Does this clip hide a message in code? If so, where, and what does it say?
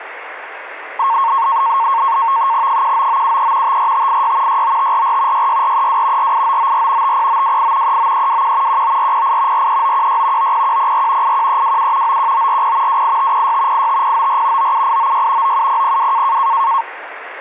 Yes: NAVTEX (SITOR-B), 100 baud, 170 Hz shift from 1.0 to 16.8 s, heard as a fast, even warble, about 1000 Hz centre, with radio static. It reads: 19973 54586 69544 66432 48994 50928 39321 19408 43916 90104 81327 91940 28506 85094 97896 97002